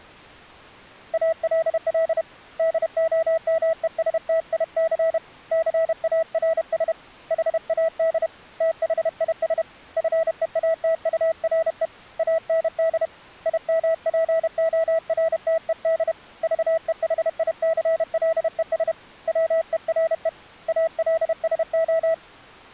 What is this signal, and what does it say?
Morse code, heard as a keyed tone, hand-sent with a paddle, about 31 wpm, 650 Hz. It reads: ALL DOMESTIC CARS HAD THIS FEATURE AND IMPORTED VEHICLES WERE ALSO